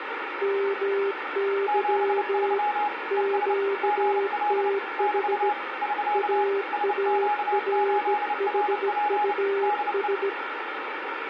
Morse code, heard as two keyed tones, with radio static and room echo. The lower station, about 17 wpm, 400 Hz: MY QTH AARHUS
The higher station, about 29 wpm, 830 Hz: 73 ES GL <BT> <SK> SQ8RP DE